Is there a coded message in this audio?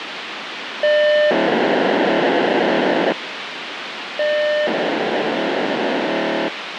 Yes: POCSAG pager data (1200 baud) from 0.8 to 6.5 s, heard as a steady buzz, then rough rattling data, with radio hiss.